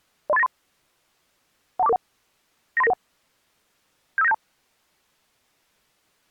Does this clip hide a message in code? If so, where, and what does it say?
Yes: five-tone selective call (EIA) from 0.3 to 4.3 s, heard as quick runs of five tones, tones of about 30 ms. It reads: 03893 12441 93991 75972